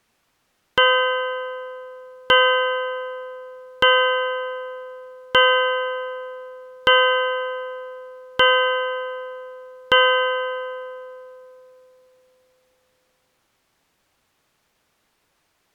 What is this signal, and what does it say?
Clock strike, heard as a bell. 7. Seven o'clock.